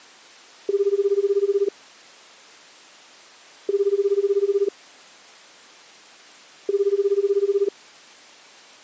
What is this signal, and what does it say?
Telephone call progress tone (Japanese plan), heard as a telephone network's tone, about 380, 400, 420 Hz, 1 s on and 2 s off. Ringback tone.